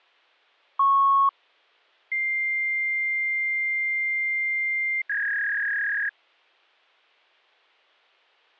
Fax machine handshake, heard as a beep, a long tone and a warble.